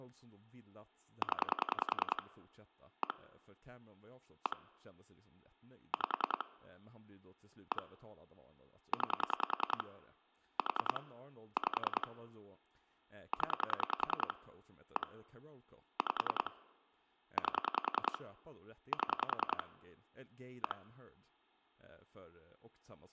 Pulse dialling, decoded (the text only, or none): 0 1 1 5 1 9 4 5 0 1 5 8 7 1